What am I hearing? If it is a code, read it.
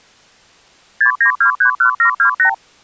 Multi-frequency trunk signalling (R2, with the far end's replies), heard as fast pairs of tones, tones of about 100 ms. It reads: 69231728